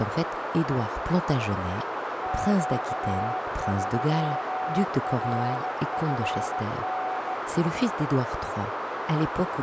Morse code, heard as a keyed tone, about 16 wpm, 750 Hz, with heavy radio static, a narrow filter and speech in French. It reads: Q3RFN